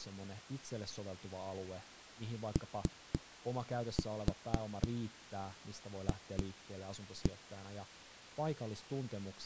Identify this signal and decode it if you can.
Tap code, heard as knocks on a wall, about 3 knocks a second, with speech in Finnish. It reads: OF